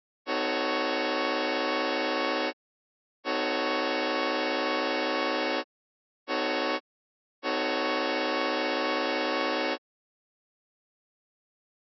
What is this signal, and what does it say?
Train horn signal, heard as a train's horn. 2 long, 1 short, 1 long. On North American railways: approaching a public crossing.